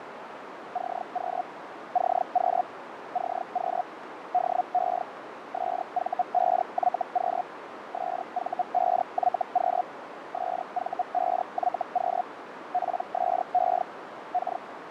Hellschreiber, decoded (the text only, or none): CQ CQ CQ DE SV5YQ SV5YQ SV5YQ PSE K